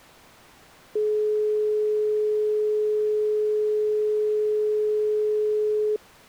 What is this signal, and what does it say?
Telephone call progress tone (425 Hz plan, as in most of Europe), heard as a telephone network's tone, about 420 Hz. Dial tone.